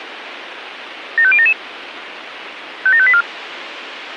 Five-tone selective call (ZVEI), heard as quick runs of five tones, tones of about 70 ms, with radio hiss. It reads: 75077 57584